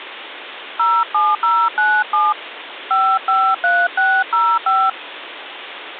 DTMF, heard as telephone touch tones, dialled by hand, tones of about 240 ms, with phone line noise. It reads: 07097 553605